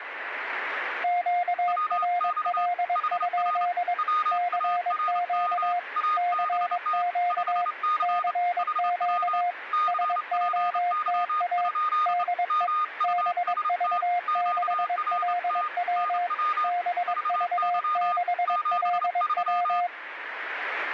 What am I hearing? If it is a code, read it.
Morse code, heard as two keyed tones, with radio static. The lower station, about 22 wpm, 710 Hz: QRL? CQ CQ CQ SOTA DE BV6LW BV6LW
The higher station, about 28 wpm, 1230 Hz: WX HR WARM ABT 5C HW CPY? MUST QRT NW VY 73